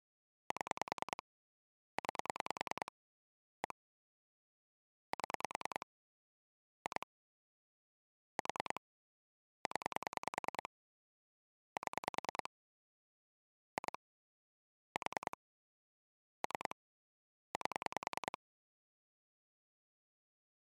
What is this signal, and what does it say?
Pulse dialling, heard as clicks on a phone line, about 10 pulses a second. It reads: 7 9 1 7 2 4 0 7 2 4 3 8